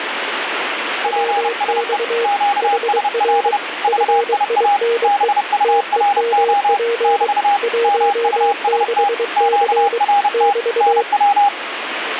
Morse code, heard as two keyed tones, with radio static. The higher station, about 30 wpm, 810 Hz: PSE QSL VIA BURO <BT> MUST QRT NW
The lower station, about 23 wpm, 470 Hz: WX HR FINE TEMP 16C <BT>